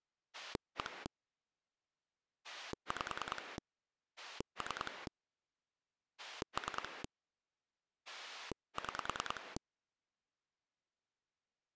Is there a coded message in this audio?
Yes: pulse dialling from 0.3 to 9.6 s, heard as a rotary dial, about 10 pulses a second. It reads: 1 5 3 3 6